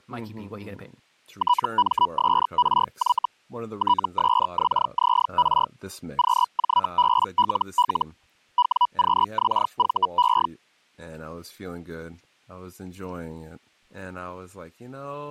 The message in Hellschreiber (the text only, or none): TMSRY TSXZR QJBLL WQXVE